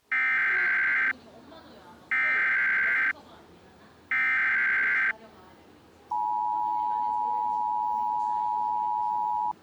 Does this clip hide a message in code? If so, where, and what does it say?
Yes: Emergency Alert System (SAME) tones (header bursts, then the 853 and 960 Hz attention tone) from 0.1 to 9.5 s, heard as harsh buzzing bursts, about 520.83 baud, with the noise of a crowd indoors.